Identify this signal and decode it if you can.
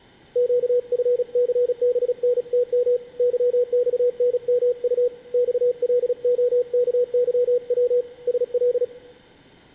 Morse code, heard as a keyed tone, hand-sent with a paddle, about 36 wpm, 490 Hz, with room echo. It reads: QFCBNTM YXNMU XLOKYW SL